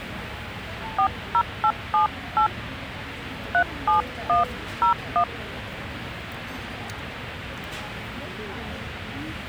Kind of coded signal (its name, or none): DTMF